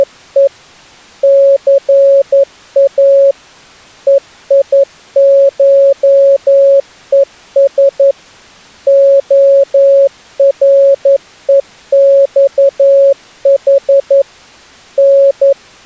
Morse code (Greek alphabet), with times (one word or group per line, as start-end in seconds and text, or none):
0.0-0.5 …
1.2-3.3 ΘΑ
4.1-8.1 ΕΙΧΕΣ
8.9-14.2 ΟΡΕΞΗ
15.0-15.9 …